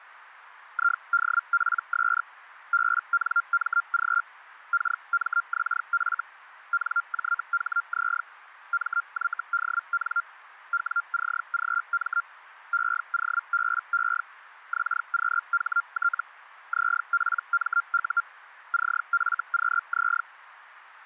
Hellschreiber (Feld-Hell, 122.5 baud), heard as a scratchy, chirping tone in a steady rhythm, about 1390 Hz, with radio static. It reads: IDPS BNMG KMXF NJHZ MYDN WCGM EOBE XQHT ZPMU CFQZ